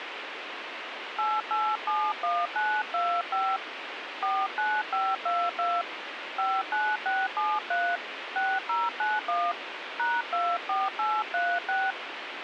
DTMF, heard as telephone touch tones, dialled by hand, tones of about 240 ms, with radio hiss. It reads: 8871925 49522 59673 6091 #24836